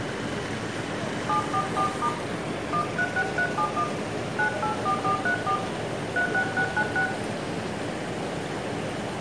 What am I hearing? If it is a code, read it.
DTMF, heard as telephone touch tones, dialled by hand, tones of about 90 ms, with room echo and the noise of a park. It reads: 744* 136371 984434 36696